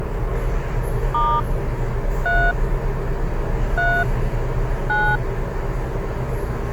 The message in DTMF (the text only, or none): * 3 3 9